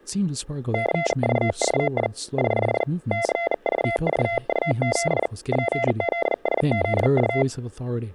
Morse code, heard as a keyed tone, hand-sent with a bug key, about 40 wpm, 680 Hz, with room echo and speech in English. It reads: CVVI <HH> CVVU7 PZSZU